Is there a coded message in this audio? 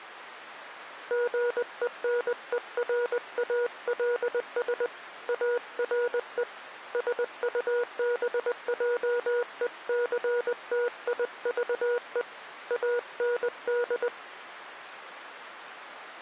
Yes: Morse code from 1.0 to 14.1 s, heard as a keyed tone, hand-sent with a paddle, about 20 wpm, 480 Hz. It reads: GENERALS ARE SUBJECTIVE AND